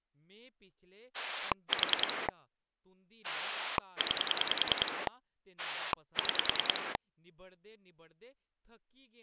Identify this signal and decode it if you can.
Pulse dialling, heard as a rotary dial, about 10 pulses a second, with speech in Dogri. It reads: 4 9 6